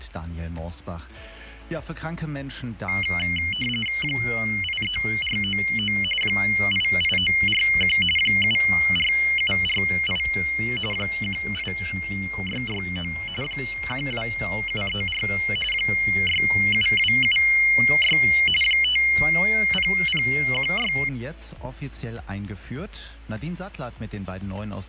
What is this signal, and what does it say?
RTTY (45.45 baud, 850 Hz shift), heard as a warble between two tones, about 2550 Hz centre, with fading. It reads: 83499 88941 74748 18669 12734 67276 50016